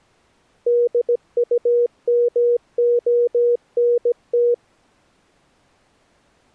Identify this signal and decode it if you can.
Morse code, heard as a keyed tone, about 17 wpm, 480 Hz. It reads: DUMONT